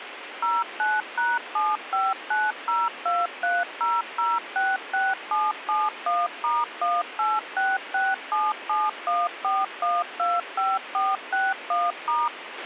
DTMF, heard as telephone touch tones, dialled by machine, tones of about 200 ms, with radio hiss and a squelch burst at the end. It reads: 09#7590230066771*18667714125461*